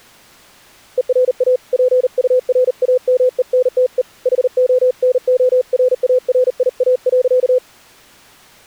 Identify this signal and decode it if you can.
Morse code, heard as a keyed tone, hand-sent with a paddle, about 39 wpm, 510 Hz. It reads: ERA PURAMENTE HONORARIA.